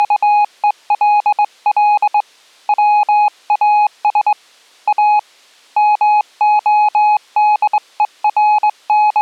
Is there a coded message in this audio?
Yes: Morse code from 0.0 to 9.2 s, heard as a keyed tone, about 21 wpm, 840 Hz. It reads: … WAS A …